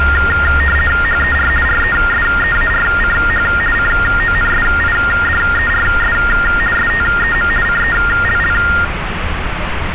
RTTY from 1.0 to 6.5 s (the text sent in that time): HER RESEARCH CONSIDERS